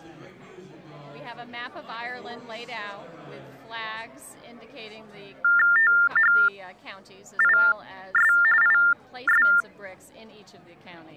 TTY/TDD text telephone tones (45.45 baud Baudot), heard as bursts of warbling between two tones, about 400 Hz shift, 1600 Hz centre. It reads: THIS IS